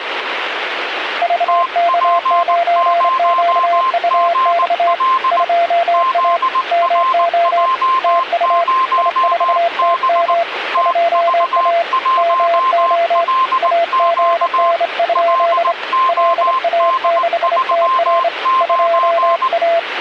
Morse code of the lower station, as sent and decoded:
...- -.- ----. --.- ..- -..- / ..--- .- / -- --- / - ..- / .. ....- - -- / ..--- .- / -- --- / .- --. -. ..--.. / .-.. .- -.... - .-. / ..--- .-
VK9QUX 2A MO TU I4TM 2A MO AGN? LA6TR 2A

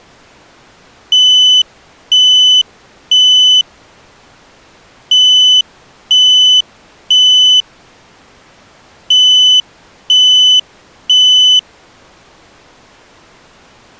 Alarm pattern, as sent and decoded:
3 beeps and a pause
temporal three

